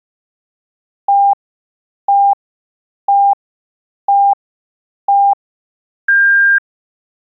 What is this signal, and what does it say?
Radio time signal (five pips and a higher one, as on Chinese radio), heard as pips.